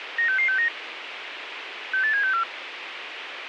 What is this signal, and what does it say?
Five-tone selective call (CCIR), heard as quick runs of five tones, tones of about 100 ms, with radio hiss. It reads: 96669 68764